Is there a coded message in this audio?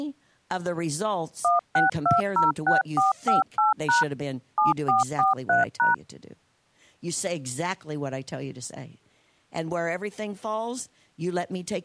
Yes: DTMF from 1.4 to 5.9 s, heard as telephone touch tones, dialled by machine, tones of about 150 ms, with speech in English. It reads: 16206458# 7443#